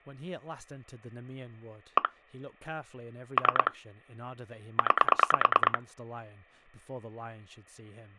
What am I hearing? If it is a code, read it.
Pulse dialling, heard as clicks on a phone line, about 9 pulses a second, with speech in English. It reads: 1 3 9